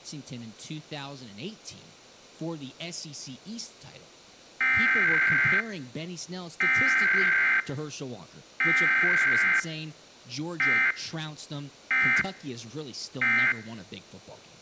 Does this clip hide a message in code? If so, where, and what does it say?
Yes: Emergency Alert System (SAME) tones (header bursts, then end-of-message bursts) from 4.6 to 13.5 s, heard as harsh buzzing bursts, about 520.83 baud, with speech in English.